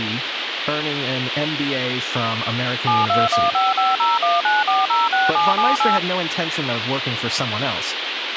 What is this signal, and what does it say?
DTMF, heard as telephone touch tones, dialled by machine, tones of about 180 ms, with radio hiss, a squelch burst at the end and speech in English. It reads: 72155019406778